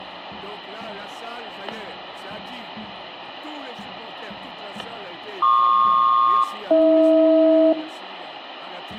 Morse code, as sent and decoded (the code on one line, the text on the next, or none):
none